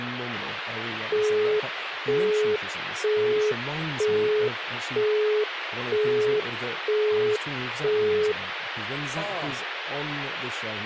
Telephone call progress tone (single-tone plan, as in Europe, Japan and elsewhere), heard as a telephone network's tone, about 420 Hz, 0.48 s on and 0.48 s off, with phone line noise and speech in English. Busy tone.